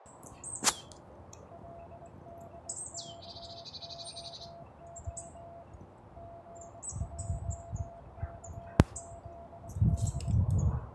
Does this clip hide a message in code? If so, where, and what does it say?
Yes: Morse code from 1.5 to 10.4 s, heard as a keyed tone, hand-sent with a straight key, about 21 wpm, 680 Hz, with heavy radio static and a narrow filter. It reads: LDKOO GJKZD